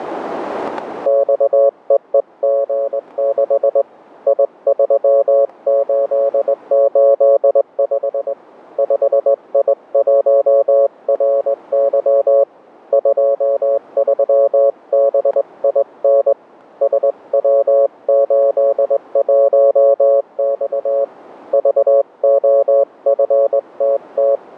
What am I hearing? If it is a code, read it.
Morse code, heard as a keyed tone, hand-sent with a straight key, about 20 wpm, 560 Hz, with static crashes. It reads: XEEG6 I3885 5I1RY 23BIN SW81X VOFTT